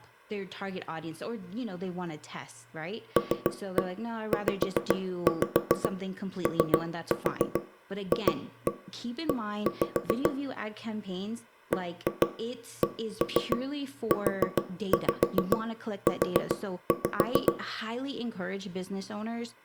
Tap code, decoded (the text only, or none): LZOFE BCUU